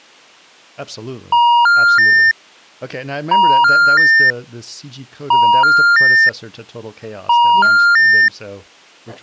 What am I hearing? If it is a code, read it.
Telephone call progress tone (ITU plan), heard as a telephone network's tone, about 950, 1400, 1800 Hz, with speech in English. Special information tone.